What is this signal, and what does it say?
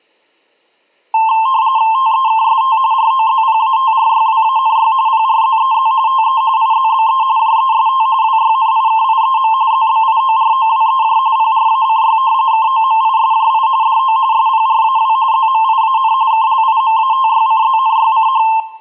RTTY (45.45 baud, 170 Hz shift), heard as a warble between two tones, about 970 Hz centre, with room echo. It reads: TEKST ROZPATRYWANY PRZEZ TE IZBE JEST WYNIKIEM ZBIOROWEJ PRACY KOMISJI DO SPRAW ZMIAN KLIMATYCZNYCH